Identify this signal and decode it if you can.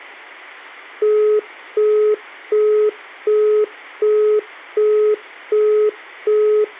Telephone call progress tone (as in the UK, Australia and similar networks), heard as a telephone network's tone, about 420 Hz, 0.375 s on and 0.375 s off. Busy tone.